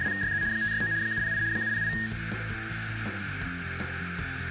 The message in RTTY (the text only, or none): … 569 708 708